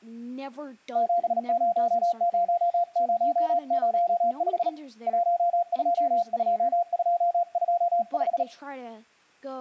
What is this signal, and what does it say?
Morse code, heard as a keyed tone, hand-sent with a bug key, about 37 wpm, 690 Hz, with speech in English. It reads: 700005 122225